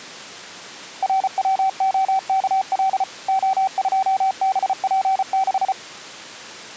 Morse code, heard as a keyed tone, machine-sent, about 34 wpm, 770 Hz. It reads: RWOKL O2BP6